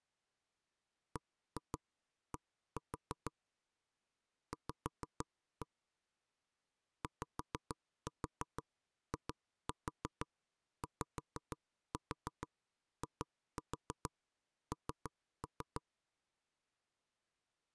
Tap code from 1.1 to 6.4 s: BD V

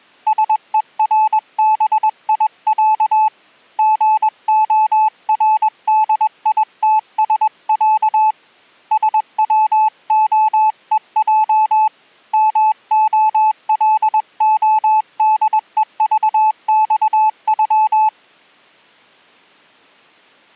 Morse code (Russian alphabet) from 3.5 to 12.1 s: ГОРДИТСЯ СВОЕЙ

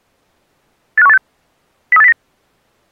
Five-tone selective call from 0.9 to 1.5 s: 85186

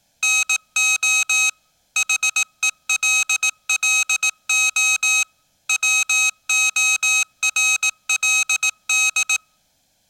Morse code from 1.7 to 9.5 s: HELLO WORLD

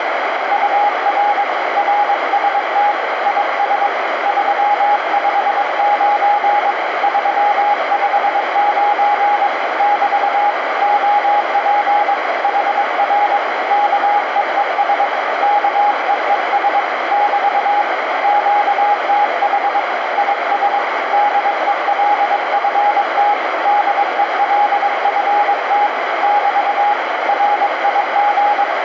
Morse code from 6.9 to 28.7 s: 359 <BT> OP HR KEES KEES <BT> QTH IS DELFT DELFT <BT> RIG

